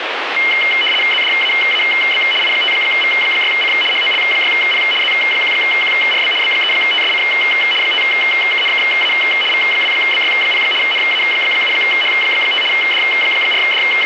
RTTY (75 baud, 850 Hz shift), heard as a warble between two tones, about 2550 Hz centre, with radio static. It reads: ZDAAB I5V6C HOL6P Z1QRB B3TSC 5KNKA V2BY0 NA7H5 …